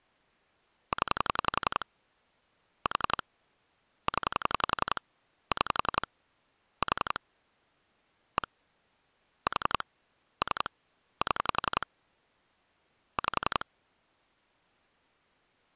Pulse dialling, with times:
0.9-1.9 0
2.9-3.2 4
4.1-5.0 0
5.5-6.1 6
6.8-7.2 4
8.4-8.5 1
9.5-9.8 4
10.4-10.7 3
11.2-11.9 7
13.2-13.6 5

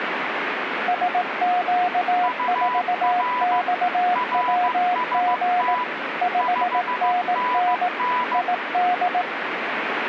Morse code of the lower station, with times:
0.9-5.7 SQ4XWG
6.2-7.9 5NN
8.3-9.2 ID

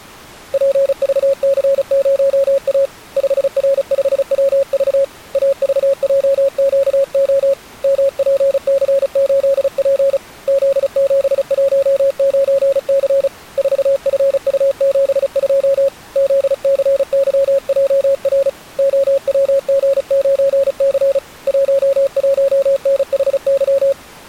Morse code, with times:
0.5-2.9 PVC0A
3.2-5.0 5R5WV
5.4-7.5 AVJQO
7.8-10.2 MPC8P
10.5-13.3 Z719C
13.6-15.9 4FU72
16.2-18.5 ZCYJR
18.8-21.2 OWG9C
21.5-23.9 11NHY

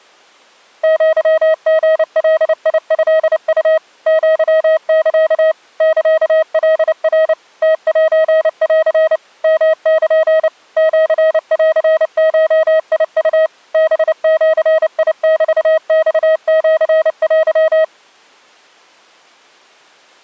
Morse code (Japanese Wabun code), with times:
0.8-3.8 アリガトウ
4.1-5.5 アサ
5.8-7.3 サカナ
7.6-9.2 ムセン
9.4-10.5 ヨル
10.8-13.5 シンゴウ
13.7-17.8 ハジメマシテ

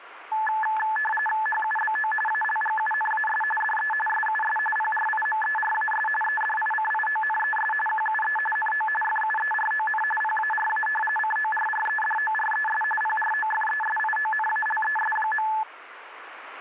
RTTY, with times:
1.5-2.1 HUBO
2.3-3.4 ALGUNAS
3.6-3.9 DE
4.1-4.6 SUS
4.8-6.1 PRIMERAS
6.2-7.7 EDICIONES
7.9-8.4 QUE
8.6-8.9 NO
9.0-10.0 FUERON
10.2-10.9 PARA
11.2-12.8 CORREDORES
13.0-15.5 PROFESIONALES.

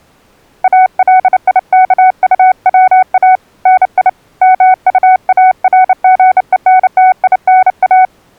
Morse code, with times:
0.6-3.4 ALIKUWA
3.7-4.1 NI
4.4-8.0 MUARGENTINA

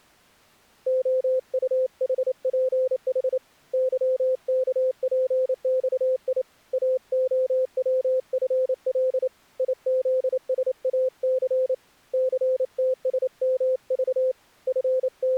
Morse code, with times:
0.9-3.4 OUHPH
3.7-6.4 YKPXI
6.7-9.3 AOWFL
9.6-11.7 IZSAC
12.1-14.3 CTSMV
14.7-15.4 …

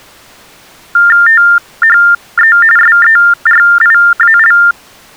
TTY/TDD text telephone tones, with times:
1.3-2.6 THE
2.8-4.6 SERIAL

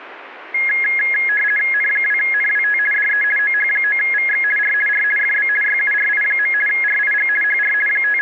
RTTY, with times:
1.7-2.8 N2NWT
2.9-3.2 DE
3.4-4.4 OH9VX
4.6-4.7 R
4.9-5.0 R
5.2-5.5 FB
5.6-6.5 YURI.
6.7-7.3 RIG
7.4-7.7 HR
7.9-8.2 …

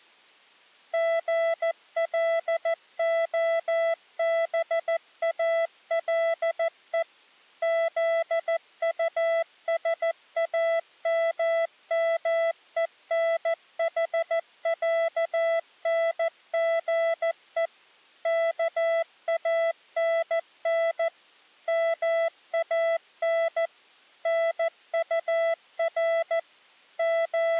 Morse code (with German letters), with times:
0.9-7.0 GLOBALE
7.6-17.7 ZUSAMMENHÄNGE
18.3-21.1 KANN
21.7-23.7 MAN
24.3-26.4 NUR
27.0-27.6 …

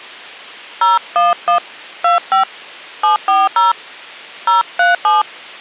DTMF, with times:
0.8-1.6 011
2.0-2.4 25
3.0-3.7 740
4.5-5.2 037

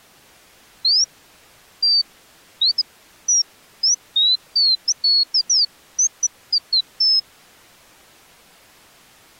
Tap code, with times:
none

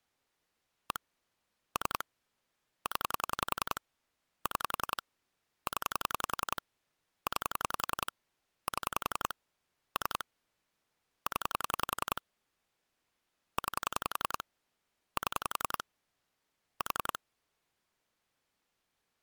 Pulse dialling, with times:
0.9-1.0 1
1.8-2.0 3
2.9-3.8 0
4.5-5.0 6
5.7-6.6 0
7.3-8.1 9
8.7-9.3 7
10.0-10.2 3
11.3-12.2 0
13.6-14.4 9
15.2-15.8 7
16.8-17.2 4

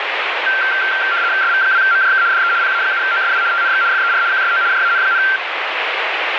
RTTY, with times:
1.4-2.2 SV2MJK
2.3-2.5 DE
2.6-3.4 PA7OSW
3.5-3.8 TNX
3.9-4.2 FER
4.3-4.6 QSO
4.7-5.2 JAN,

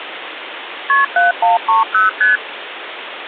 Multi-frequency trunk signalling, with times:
0.9-1.0 KP
1.2-2.1 7130
2.2-2.4 ST

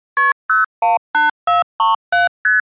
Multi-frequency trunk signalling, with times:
0.2-0.3 KP
0.5-2.3 018437
2.4-2.6 ST

